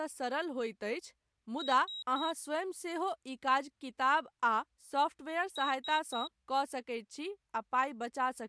Beep code, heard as a piezo beeper, played twice, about 3850 Hz, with speech in Maithili. 3 short. In AMI BIOS tables: failure in the first 64 KB of memory; in Dell tables: chipset error.